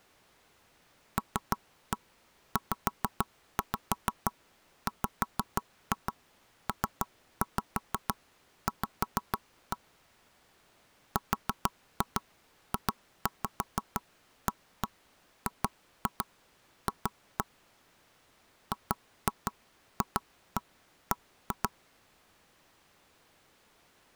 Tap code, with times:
1.2-9.8 LZWPV
11.2-17.4 RJAGF
18.7-21.7 GFB

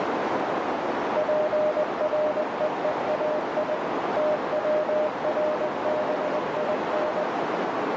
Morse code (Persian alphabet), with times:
1.2-3.8 پرههای
4.2-7.2 توربین

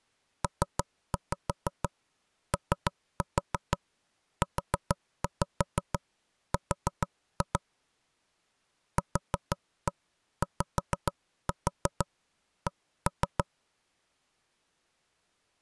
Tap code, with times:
0.4-7.6 POUR
9.0-13.4 QYC

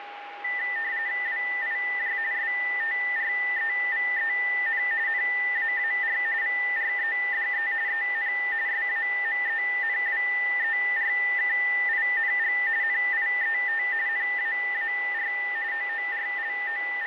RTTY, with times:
1.3-2.2 WIJ
2.3-4.8 STREVEN
5.1-6.2 NAAR
6.4-7.7 VREDE
7.9-8.3 EN
8.7-12.6 SAMENWERKING
12.8-13.8 NIET
14.1-15.3 NAAR
15.7-17.1 …

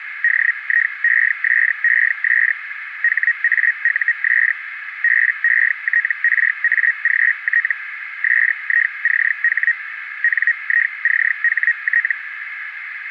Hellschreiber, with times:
0.2-2.5 DIESES
3.0-4.5 HAUS
5.0-7.7 BETRAGT
8.2-9.7 SICH
10.2-12.1 NICHT

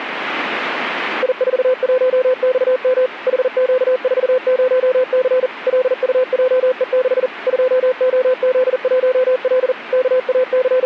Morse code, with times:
1.2-3.1 I41XM
3.3-5.5 HQ40C
5.7-7.3 LUJE6
7.5-9.7 2OZ1L
9.9-10.9 …

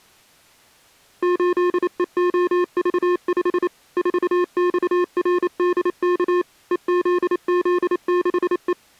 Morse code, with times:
1.2-3.7 8EOV5
4.0-6.4 4XRDK
6.7-8.7 EZZ6E

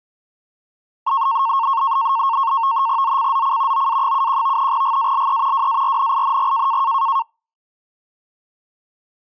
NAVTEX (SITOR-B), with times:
3.0-3.9 ZCZC
3.7-4.7 OA71
4.7-5.7 GALE
5.5-6.8 WARNING

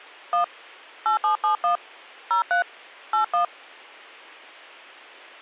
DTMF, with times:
0.3-0.4 1
1.1-1.8 8771
2.3-2.6 03
3.1-3.4 81

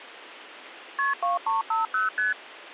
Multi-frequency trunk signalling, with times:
1.0-1.1 KP
1.2-2.1 2350
2.2-2.3 ST

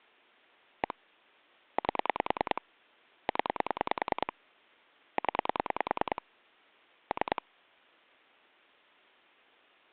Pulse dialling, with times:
0.8-0.9 1
1.8-2.6 8
3.3-4.3 0
5.2-6.2 0
7.1-7.4 3

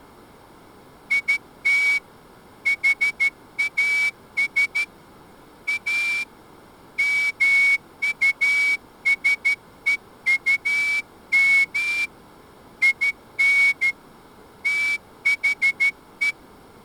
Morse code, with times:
1.1-2.0 IT
2.7-4.8 HAS
5.7-6.2 A
7.0-12.0 MUSEUM
12.8-13.9 IN
14.7-16.3 THE

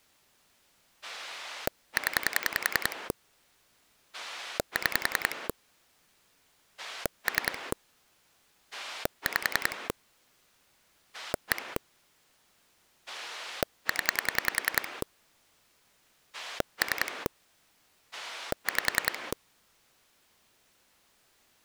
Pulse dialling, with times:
1.0-3.1 0
4.1-5.5 6
6.8-7.7 3
8.7-9.9 5
11.1-11.8 1
13.1-15.0 0
16.3-17.3 3
18.1-19.3 5

